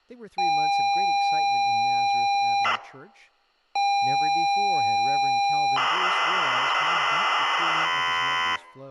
ZX Spectrum tape loading, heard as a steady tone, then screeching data, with speech in English.